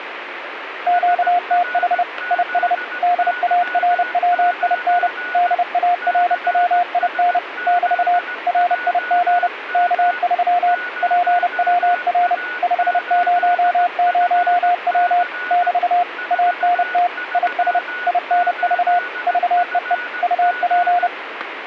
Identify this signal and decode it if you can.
Morse code, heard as a keyed tone, machine-sent, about 30 wpm, 710 Hz, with radio static and a weaker station near 1470 Hz. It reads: QTH IS DARWIN DARWIN <BT> RIG K3 PWR 500W <BT> ANT IS INV VEE UP